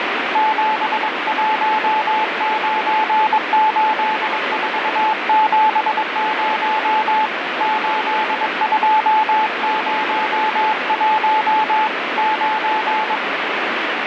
Morse code, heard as a keyed tone, hand-sent with a paddle, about 22 wpm, 870 Hz, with heavy radio static. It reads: 7198470 8201 9